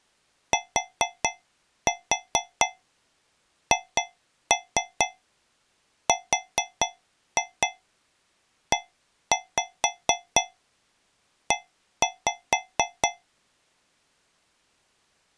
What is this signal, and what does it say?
Tap code, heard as taps on a metal pipe, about 4 knocks a second. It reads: THREE